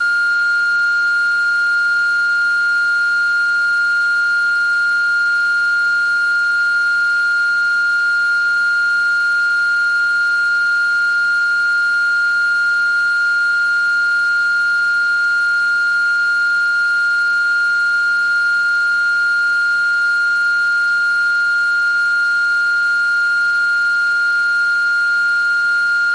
A steady tone. There is no code.